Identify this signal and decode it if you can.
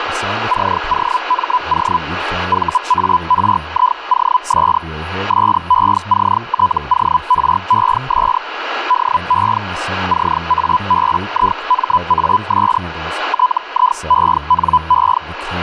Hellschreiber (Feld-Hell, 122.5 baud), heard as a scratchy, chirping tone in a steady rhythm, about 1000 Hz, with radio static, a steady whistle near 1660 Hz and speech in English. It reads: COMO VARIOS SECTORES DE CABIMAS TIENE